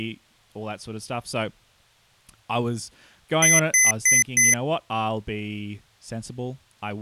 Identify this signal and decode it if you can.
Beep code, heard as beeps from a small speaker, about 2050 Hz, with speech in English. 4 short. In AMI BIOS tables: system timer failure; in Dell tables: memory read or write failure.